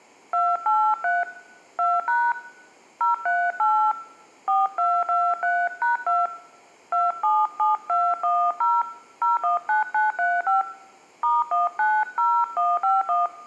DTMF, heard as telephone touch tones, dialled by hand, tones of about 240 ms, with room echo. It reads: 283 2# 038 4223#2 277210 019935 *190151